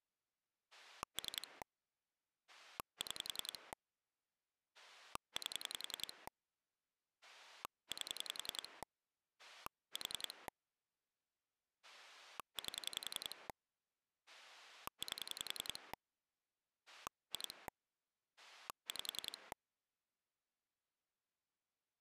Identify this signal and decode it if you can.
Pulse dialling, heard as a rotary dial, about 10 pulses a second. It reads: 3 6 8 8 4 8 8 2 5